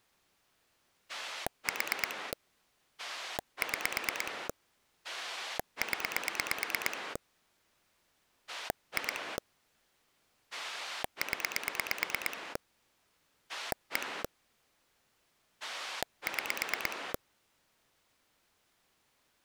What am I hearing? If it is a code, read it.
Pulse dialling, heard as a rotary dial, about 9 pulses a second. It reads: 4 6 0 2 0 1 6